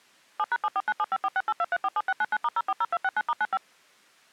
DTMF, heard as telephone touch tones, dialled by machine, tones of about 40 ms. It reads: 7#749754682347699*040269*95